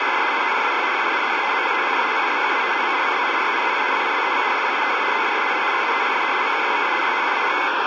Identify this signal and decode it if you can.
RTTY (75 baud, 170 Hz shift), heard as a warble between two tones, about 2150 Hz centre, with radio static. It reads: … NOQAY QCNLF OMOHG VCVKZ OMDVB DXIZU CCBEV JPITQ OFSLB YDTGF VKYVI GHUAH